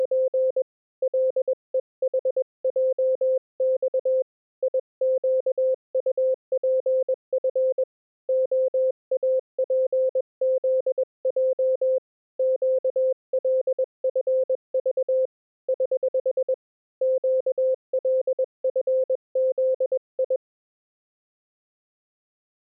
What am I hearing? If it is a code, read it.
Morse code, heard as a keyed tone, hand-sent with a paddle, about 21 wpm, 520 Hz. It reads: … LEHJX IQUPF OAPZJ QLFV <HH> QLFZI